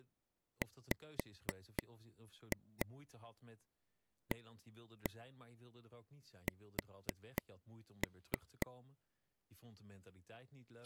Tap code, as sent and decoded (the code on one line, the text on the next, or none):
5-2 1-1 4-3
WAS